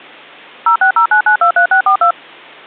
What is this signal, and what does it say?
DTMF, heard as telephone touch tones, dialled by machine, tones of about 100 ms. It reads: 0609923642